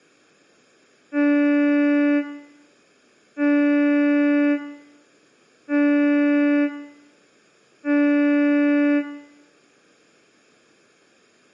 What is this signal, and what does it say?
Ship horn signal, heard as a ship's horn, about 290 Hz, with room echo. 4 short. At sea: a pilot vessel's identity signal in fog.